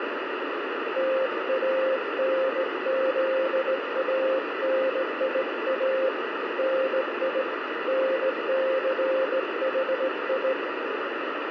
Morse code, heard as a keyed tone, hand-sent with a straight key, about 18 wpm, 530 Hz, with heavy radio static. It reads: TANZANIA NI NCHI